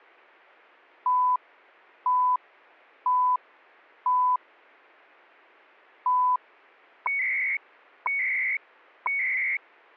Radio time signal (CHU, Canada), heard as beeps and data bursts, one a second.